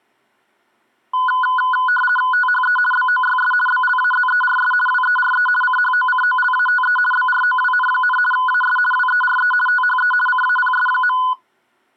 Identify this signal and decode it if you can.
RTTY (50 baud, 450 Hz shift), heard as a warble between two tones, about 1240 Hz centre. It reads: THE BOYS BLAZERS WERE CHOCOLATE BROWN, AS WERE THE CAPS.